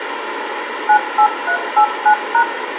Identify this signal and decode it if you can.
DTMF, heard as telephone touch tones, dialled by machine, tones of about 80 ms, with phone line noise and room echo. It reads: 98389#